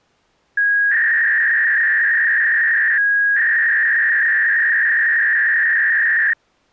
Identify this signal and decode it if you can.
300-baud modem data (V.21 tones), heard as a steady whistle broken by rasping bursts, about 300 baud, 200 Hz shift.